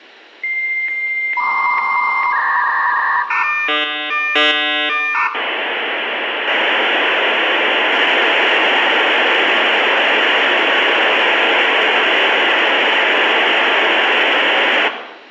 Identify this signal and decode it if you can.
Dial-up modem handshake (V.34 or later), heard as a whistle, warbles, then hiss, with room echo.